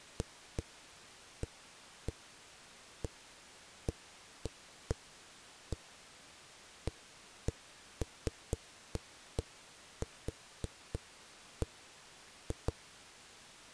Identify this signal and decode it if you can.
Irregular knocks on a wall. There is no code.